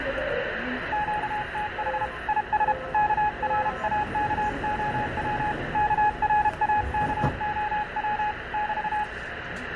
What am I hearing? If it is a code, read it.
Morse code, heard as a keyed tone, hand-sent with a paddle, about 32 wpm, 840 Hz, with radio static and the noise inside a subway train. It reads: QTH IS KRAKOW KRAKOW <BT>